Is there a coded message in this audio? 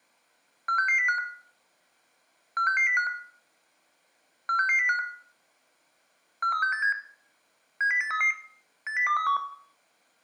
Yes: five-tone selective call (CCIR) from 0.7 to 9.4 s, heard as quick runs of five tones, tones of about 100 ms, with room echo. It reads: 46605 46605 46605 43687 70833 80231